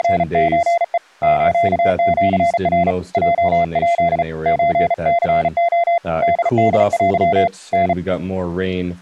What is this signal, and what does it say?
Morse code (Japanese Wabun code), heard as a keyed tone, hand-sent with a bug key, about 35 wpm, 690 Hz, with speech in English. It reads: … スシナ ヲヱ ソニレ ホホテ タ